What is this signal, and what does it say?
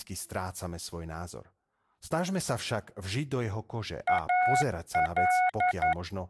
Morse code, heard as a keyed tone, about 11 wpm, 730 Hz, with speech in Slovak. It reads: AL